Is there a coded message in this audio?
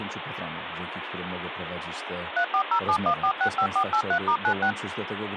Yes: DTMF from 2.4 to 4.7 s, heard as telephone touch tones, dialled by machine, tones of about 80 ms, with phone line noise and speech in Polish. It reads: 34071465483*96